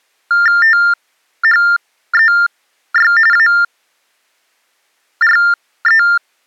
TTY/TDD text telephone tones (45.45 baud Baudot), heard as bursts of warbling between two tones, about 400 Hz shift, 1600 Hz centre. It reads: THEY ARE